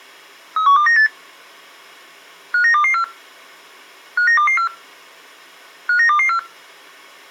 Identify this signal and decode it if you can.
Five-tone selective call (CCIR), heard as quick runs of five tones, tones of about 100 ms. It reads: 31298 59224 59224 59224